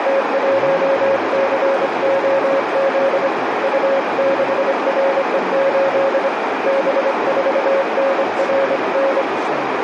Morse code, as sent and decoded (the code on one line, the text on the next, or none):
- .---- -.-. --- --.. / ..- -.... .-. . ---.. / -... ....- -. .-. -.
T1COZ U6RE8 B4NRN